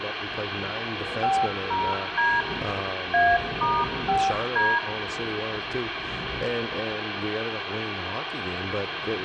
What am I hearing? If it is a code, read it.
DTMF, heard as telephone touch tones, dialled by machine, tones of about 230 ms, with phone line noise and room echo. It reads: 50D A*5D